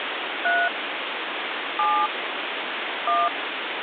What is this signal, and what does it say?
DTMF, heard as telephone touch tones, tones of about 210 ms, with phone line noise. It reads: 3 7 1